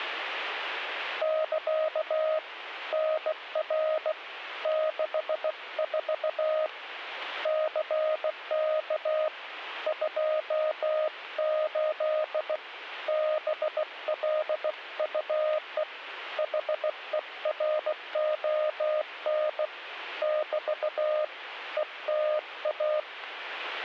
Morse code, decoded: <KA> NR 64 CK 28 BLUE HERON <BT> ETA

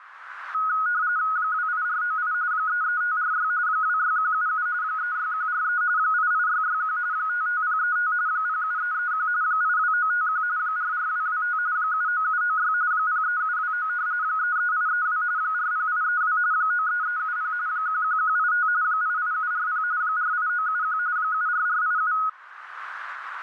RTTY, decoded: 28498 33546 26177 36143 88661 55035 07331 82951 44225 79796 03729 33832 40832 93370 11185 88740 48971 74487

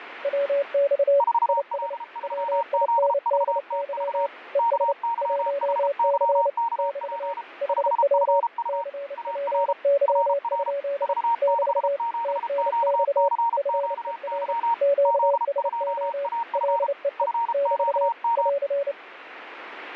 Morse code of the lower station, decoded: WX IS WINDY ES 1C <BT> HW CPY? <BT> TNX FER QSO LEE <BT> <AR>

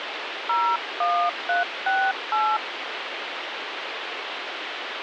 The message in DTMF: 01368

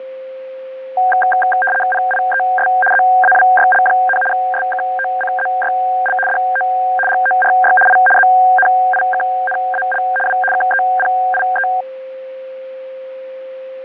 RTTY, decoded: PIES ZAWYL, SKOCZYL DO GORY I ZNIKNAL W KEPIE

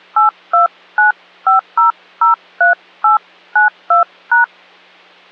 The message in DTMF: 8295003892#

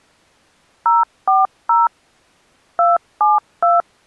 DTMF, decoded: 040 272

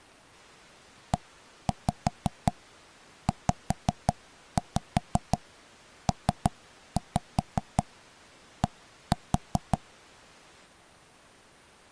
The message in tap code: EZPD

